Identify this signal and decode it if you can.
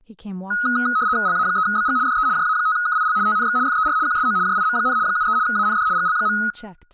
RTTY (75 baud, 170 Hz shift), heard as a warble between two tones, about 1360 Hz centre, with room echo and speech in English. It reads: LA3BG DE JA5KIL TNX FER QSO JIM, 73 AND GL.